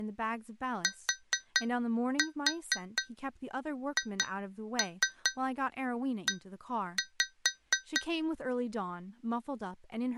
Tap code, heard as taps on glass, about 4 knocks a second, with speech in English. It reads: THE